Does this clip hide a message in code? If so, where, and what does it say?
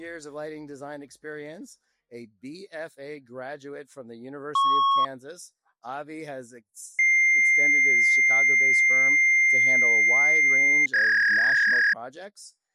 Yes: fax machine handshake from 4.5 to 11.9 s, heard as a beep, a long tone and a warble.